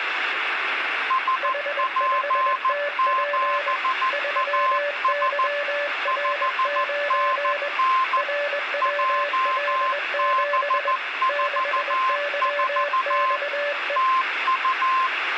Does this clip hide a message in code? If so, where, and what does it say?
Yes: Morse code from 1.0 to 15.1 s, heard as two keyed tones, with radio static. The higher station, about 14 wpm, 1050 Hz: SP7AS 5NN JB44 TU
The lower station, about 21 wpm, 580 Hz: H5TP 3YR9 RWL7 6YXE